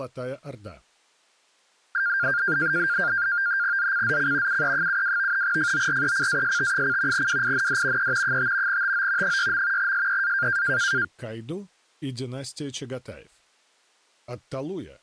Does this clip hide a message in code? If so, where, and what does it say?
Yes: NAVTEX (SITOR-B), 100 baud, 170 Hz shift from 1.9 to 11.0 s, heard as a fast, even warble, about 1500 Hz centre. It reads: ZCZC UE72 FORECAST: WIND E 5 TO 6. SEA